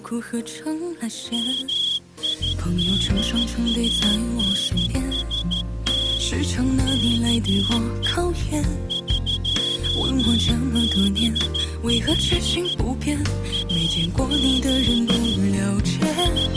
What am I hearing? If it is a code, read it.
Morse code (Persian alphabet), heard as a whistle, hand-sent with a straight key, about 13 wpm. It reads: میدانست که قبل از …